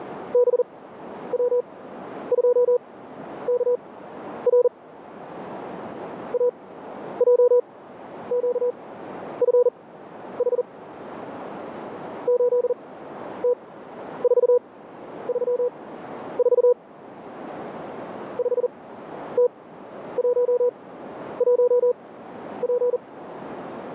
Morse code, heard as a keyed tone, machine-sent, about 40 wpm, spaced as for 11 wpm, 490 Hz, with radio static. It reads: BW2KR AJQFH 8T434 5T11P